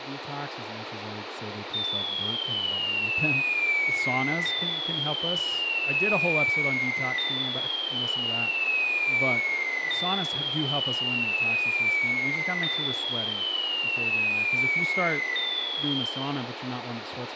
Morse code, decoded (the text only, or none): none